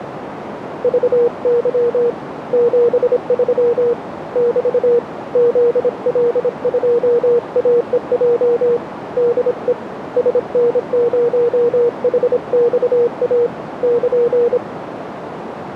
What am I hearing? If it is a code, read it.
Morse code, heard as a keyed tone, hand-sent with a paddle, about 26 wpm, 470 Hz, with radio static and a narrow filter. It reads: VY 73 <BT> ZL2AEJ DE SN0HXA <KN>